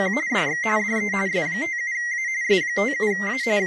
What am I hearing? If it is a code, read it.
RTTY (45.45 baud, 170 Hz shift), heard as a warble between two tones, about 2000 Hz centre, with speech in Vietnamese. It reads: … DX DE S57A S57A …